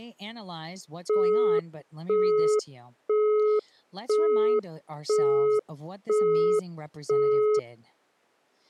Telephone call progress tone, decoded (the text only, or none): busy tone